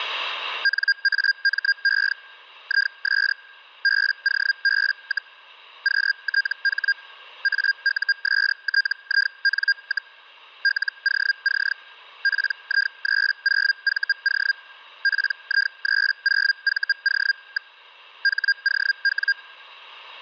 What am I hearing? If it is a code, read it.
Hellschreiber (Feld-Hell, 122.5 baud), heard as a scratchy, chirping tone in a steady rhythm, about 1600 Hz. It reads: NAME IS BOB, QTH AUSTIN, LOC PI30VO PI30VO. HOW